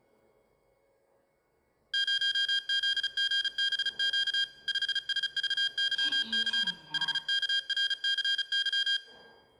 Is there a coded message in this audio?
Yes: Morse code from 1.9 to 9.0 s, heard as electronic beeps, machine-sent, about 35 wpm, 1600 Hz, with the noise inside a lift. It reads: 0ZGBQ 5SVYC HKRCY